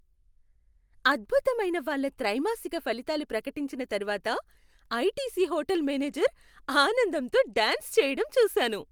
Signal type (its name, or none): none